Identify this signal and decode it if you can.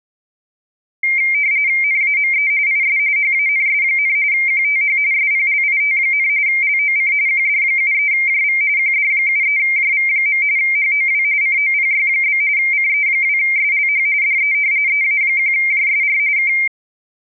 RTTY (45.45 baud, 170 Hz shift), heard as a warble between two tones, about 2200 Hz centre. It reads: NAME IS HANS, QTH SPLIT, LOC QD73JV QD73JV. HOW COPY? CE2SLH DE EA1JSR K